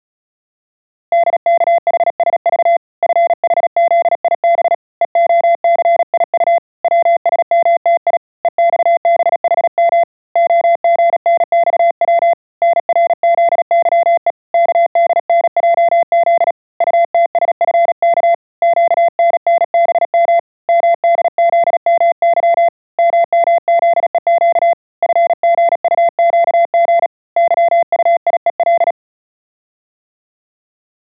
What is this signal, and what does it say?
Morse code, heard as a keyed tone, hand-sent with a paddle, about 37 wpm, 680 Hz. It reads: DKHSV FHZIB EOCIU WSMTI EXBHM OGNXW NRZYE KDNJZ UTSFK QNNBM MDZMY MMZEQ FGUQG YUIEL